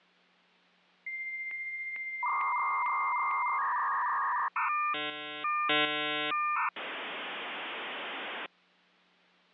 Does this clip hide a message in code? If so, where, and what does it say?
Yes: dial-up modem handshake (V.34 or later) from 1.1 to 8.5 s, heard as a whistle, warbles, then hiss.